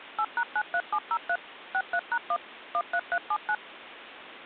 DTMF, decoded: 8#93703 63#1 13379

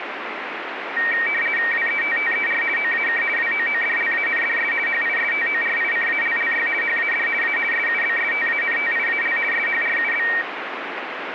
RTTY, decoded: WETTER OAK WOODLANDS HISTORICALLY HAD A SUBSTANTIAL SHRUB

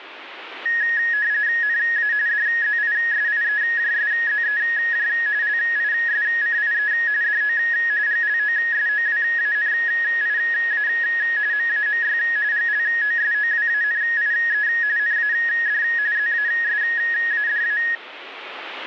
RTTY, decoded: NA DZISIEJSZEJ LISCIE DO GLOSOWANIA MAMY GLOSOWANIE NAD ZASADA

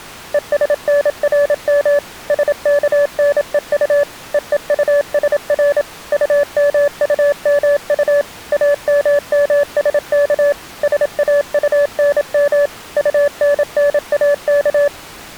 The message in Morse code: ESNRM SKNEU EEUSR UMUMU AMMSK SAUNM UNNAK

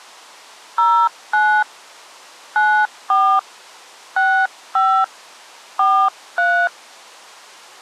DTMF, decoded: 09 94 65 43

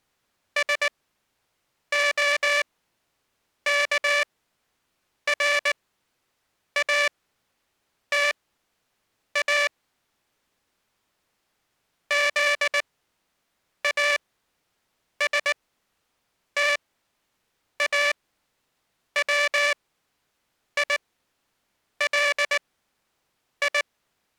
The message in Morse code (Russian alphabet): СОКРАТА ЗАСТАВИЛИ

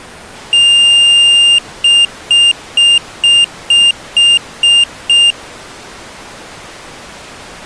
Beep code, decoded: 1 long, 8 short

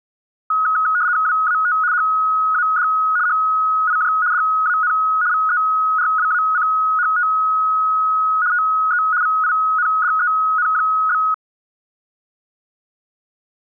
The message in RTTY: WAT HAD HIJ DAN VERWACHT TE VINDEN?

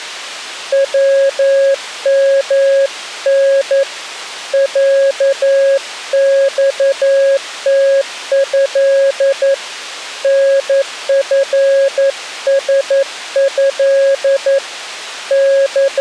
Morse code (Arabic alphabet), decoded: ومن عصته نفسه …

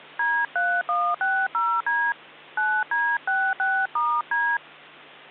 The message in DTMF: D3160D 9D66*D

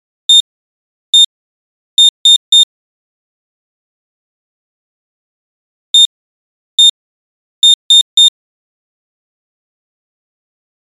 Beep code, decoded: 1-1-3

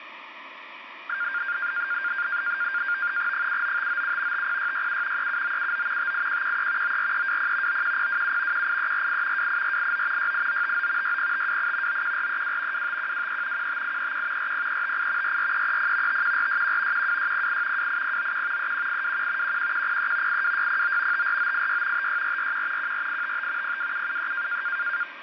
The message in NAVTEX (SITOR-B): 79597 50667 37979 58113 94320 91027 18348 28489 68959 60528 91432 25123 15831 40358 44330 51461 12608 28091 31821 11103 82609 54986 56441 14855 02773

